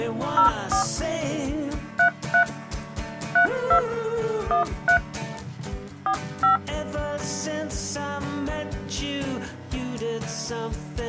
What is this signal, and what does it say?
DTMF, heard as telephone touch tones, dialled by hand, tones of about 100 ms. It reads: 04 33 32 13 45